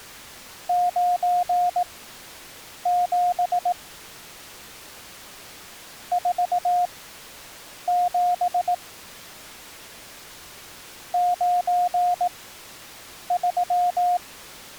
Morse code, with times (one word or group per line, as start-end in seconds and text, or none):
0.7-3.7 97
6.1-8.7 47
11.1-14.2 93